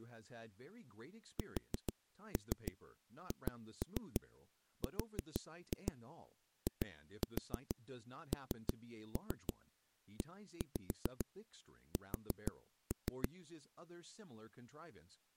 Tap code, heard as knocks on a wall, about 6 knocks a second, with speech in English. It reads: SHRINES